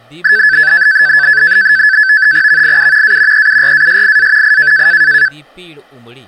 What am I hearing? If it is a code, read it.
NAVTEX (SITOR-B), 100 baud, 170 Hz shift, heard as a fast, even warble, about 1650 Hz centre, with speech in Dogri. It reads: VIU A EURASIA I